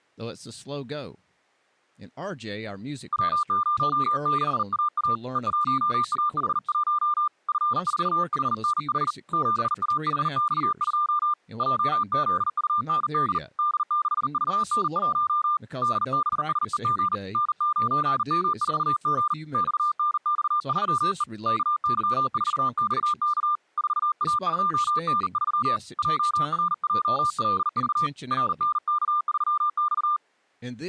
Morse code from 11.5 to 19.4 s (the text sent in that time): JZUND D6VN1 DBSEG N9M4G